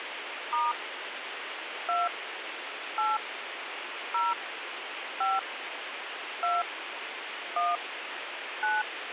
DTMF, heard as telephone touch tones, dialled by hand, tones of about 190 ms, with radio hiss. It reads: * 2 8 0 5 2 1 9